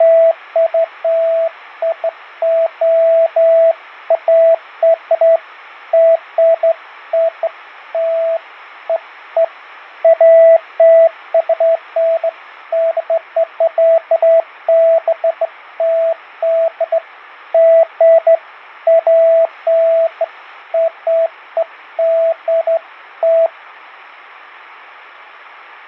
Beeps of irregular length, with fading. There is no code.